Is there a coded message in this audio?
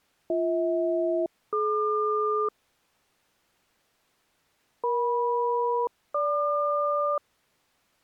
Yes: aircraft SELCAL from 0.3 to 7.2 s, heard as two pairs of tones. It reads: BH-DQ EM-GQ